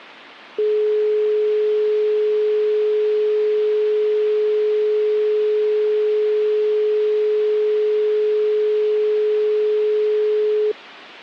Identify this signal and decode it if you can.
Telephone call progress tone (425 Hz plan, as in most of Europe), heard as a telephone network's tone, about 420 Hz. Dial tone.